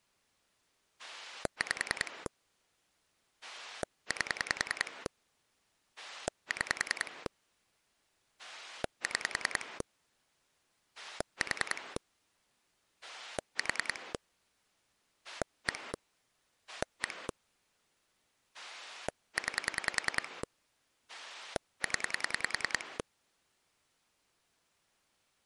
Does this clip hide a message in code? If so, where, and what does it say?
Yes: pulse dialling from 1.0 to 23.0 s, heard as a rotary dial, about 10 pulses a second. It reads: 5 8 6 6 4 4 1 1 9 0